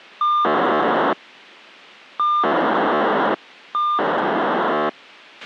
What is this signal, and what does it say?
POCSAG pager data (2400 baud), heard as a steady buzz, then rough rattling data, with a squelch burst at the end.